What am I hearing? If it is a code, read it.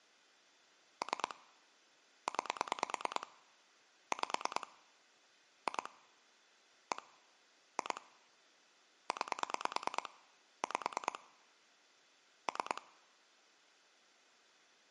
Pulse dialling, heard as clicks on a phone line, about 9 pulses a second. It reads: 3 9 5 2 1 2 9 5 3